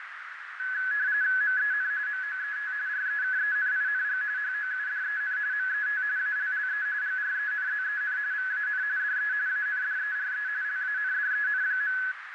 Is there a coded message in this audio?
Yes: RTTY (45.45 baud, 170 Hz shift) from 0.6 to 12.1 s, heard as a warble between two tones, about 1600 Hz centre, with radio static, fading and a narrow filter. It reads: MEN MOET REKENING HOUDEN MET ALLE GRENZEN VAN DE ANDERE LANDEN.